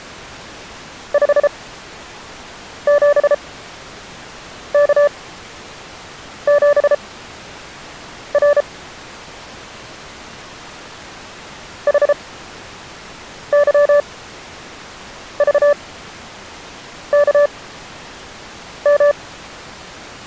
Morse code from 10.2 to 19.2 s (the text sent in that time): HYVKM